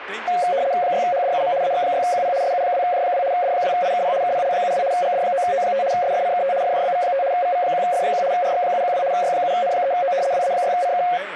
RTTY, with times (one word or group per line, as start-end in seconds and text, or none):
0.8-1.5 6HDUM
1.6-2.3 AX6QP
2.4-3.2 SU2J2
3.3-4.1 D2IKP
4.2-4.8 KPL72
4.9-5.8 GD9O5
5.9-6.5 SFCKT
6.6-7.2 FJBV5
7.3-8.2 VV1F1
8.3-9.0 RX712
9.1-10.1 Y7N3O
10.3-11.0 WA6CK